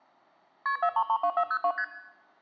Multi-frequency trunk signalling (R1, as on North American trunks), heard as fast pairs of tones, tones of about 70 ms. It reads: KP 4332402 ST